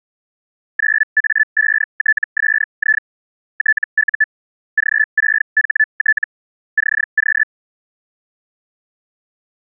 Hellschreiber (Feld-Hell, 122.5 baud), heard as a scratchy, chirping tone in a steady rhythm, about 1750 Hz. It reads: 9A5TSI TU G6HT CQ